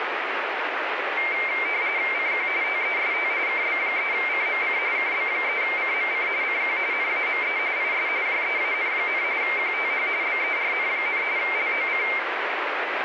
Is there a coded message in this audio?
Yes: RTTY (45.45 baud, 170 Hz shift) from 1.2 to 12.2 s, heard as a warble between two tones, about 2200 Hz centre, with radio static. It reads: CQ TEST KB3CMC KB3CMC CQ NAME IS JEAN, QTH BERN, LOC